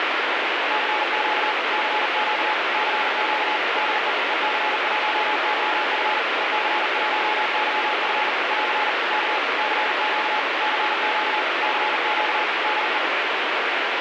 Morse code, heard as a keyed tone, machine-sent, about 40 wpm, 850 Hz, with heavy radio static. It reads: CQ CQ CQ DE EC1YF EC1YF <AR> K CQ CQ CQ DE